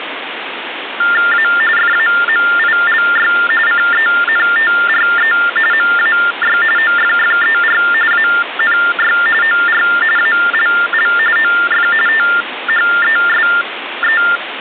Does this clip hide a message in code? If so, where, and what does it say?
Yes: TTY/TDD text telephone tones (45.45 baud Baudot) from 1.0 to 14.4 s, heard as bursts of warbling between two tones, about 400 Hz shift, 1600 Hz centre, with phone line noise. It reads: A FAMILY CENTRE MAY OFFER ANY OR ALL OF THESE